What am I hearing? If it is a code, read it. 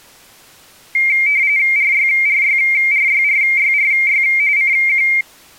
RTTY (45.45 baud, 170 Hz shift), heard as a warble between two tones, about 2200 Hz centre. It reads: RYRYRYRYRY CQ